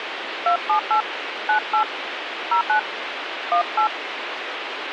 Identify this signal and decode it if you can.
DTMF, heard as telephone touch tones, dialled by hand, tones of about 100 ms, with radio hiss. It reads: 278 98 09 18